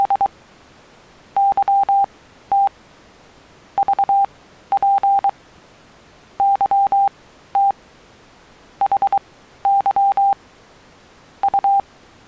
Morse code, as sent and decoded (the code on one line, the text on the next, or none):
… / -.-- - / ...- .--. / -.-- - / .... -.-- / …
… YT VP YT HY …